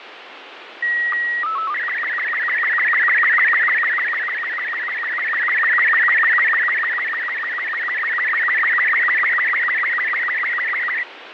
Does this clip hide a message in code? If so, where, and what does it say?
Yes: SSTV (slow-scan television), Robot 36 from 0.8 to 11.0 s, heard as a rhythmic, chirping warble, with radio static and fading.